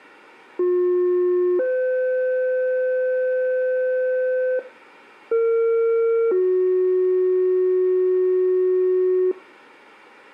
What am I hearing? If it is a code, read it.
Two-tone page, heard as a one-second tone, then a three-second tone, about 360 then 510 Hz, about 460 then 370 Hz, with room echo.